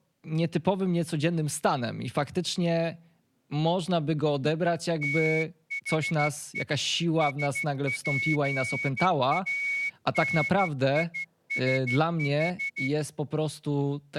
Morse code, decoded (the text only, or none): THE SPANISH